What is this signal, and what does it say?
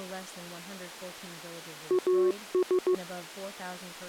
Morse code, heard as a keyed tone, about 15 wpm, 370 Hz, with speech in English. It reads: AS